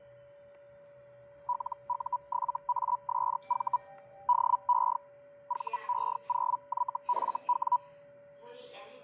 Hellschreiber (Feld-Hell, 122.5 baud), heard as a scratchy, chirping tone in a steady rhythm, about 980 Hz, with static crashes, a steady whistle near 570 Hz and the noise inside a lift. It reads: LU7ASV DE VE0YFW